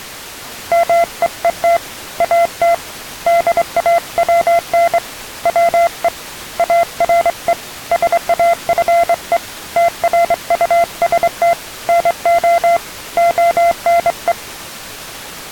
Morse code, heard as a keyed tone, hand-sent with a straight key, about 24 wpm, 680 Hz. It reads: MEET AT DAWN WE ARE SAFE TRUST NO ONE